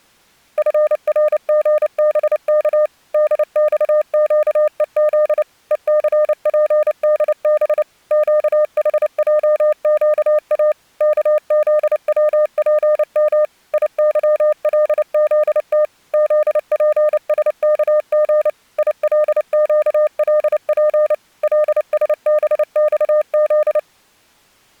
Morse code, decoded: FRGBK DXQEZ ECPDB QHJQA KZWPM IYLZT ZPSKG ILQLP LSBXZ

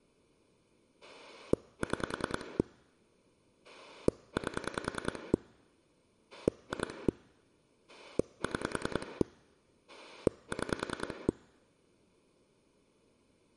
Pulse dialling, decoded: 6 8 2 6 6

